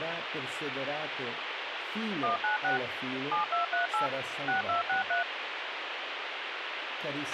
DTMF, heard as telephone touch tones, dialled by machine, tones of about 130 ms, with radio hiss and a squelch burst at the end. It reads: 196 7238 6263